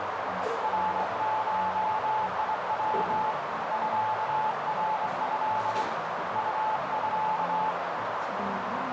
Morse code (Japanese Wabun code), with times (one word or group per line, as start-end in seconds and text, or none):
0.6-3.3 ナゴヤ
3.7-5.8 ミナト
6.4-7.7 ウミ